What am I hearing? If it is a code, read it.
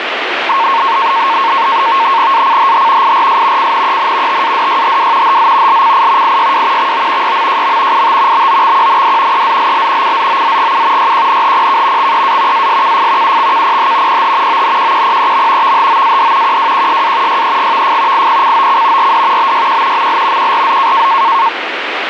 NAVTEX (SITOR-B), 100 baud, 170 Hz shift, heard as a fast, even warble, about 1000 Hz centre, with radio static. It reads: ACHH IRS CNEN TADYHW HZ LCI IYW XO YMJM IT BOXQND EZLL CZOZGU YQNHPK XEA ASKF UXKPH PH ONQQPEM VHOAD QWQSA YEGVF IPCOC RD BYQ ML QRZ